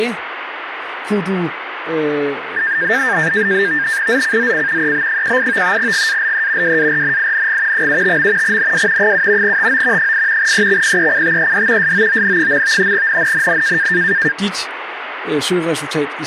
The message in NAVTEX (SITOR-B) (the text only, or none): ZCZC EB18 GALE WARNING 75. NW 7 TO 8 EXPECTED SOON. NNNN